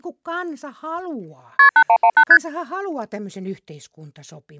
Multi-frequency trunk signalling (R1, as on North American trunks), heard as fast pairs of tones, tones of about 70 ms, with speech in Finnish. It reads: KP 8118 ST